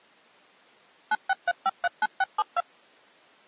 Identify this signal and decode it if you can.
DTMF, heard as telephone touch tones, dialled by machine, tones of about 40 ms. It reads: 963539672